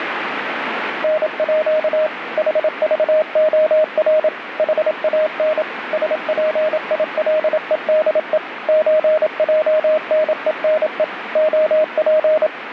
Morse code (with Danish letters), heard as a keyed tone, machine-sent, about 27 wpm, 620 Hz, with radio static. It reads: NÅ HVOR HAN SPILEDE ØJNENE OP